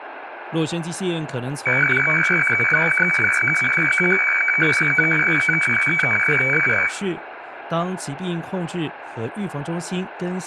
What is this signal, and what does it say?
Weather fax (radiofax), 120 lines a minute, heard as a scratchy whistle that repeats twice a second, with room echo and speech in Chinese.